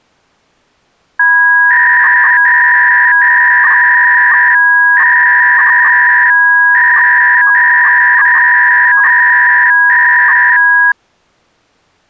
300-baud modem data (V.21 tones), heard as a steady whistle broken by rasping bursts, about 300 baud, 200 Hz shift.